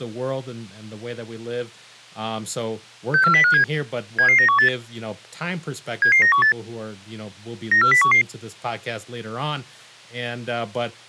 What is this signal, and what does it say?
Five-tone selective call (CCIR), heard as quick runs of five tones, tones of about 100 ms, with speech in English. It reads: 64057 77918 77918 94011